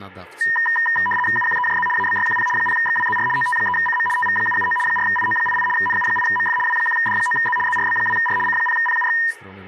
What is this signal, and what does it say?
RTTY (75 baud, 850 Hz shift), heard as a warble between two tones, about 1410 Hz centre, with speech in Polish. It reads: UQEJZ ABYQP 0XWZR OT3CM TV779 4IO88 NU8MF W1D9Z ZRB2R C0PUX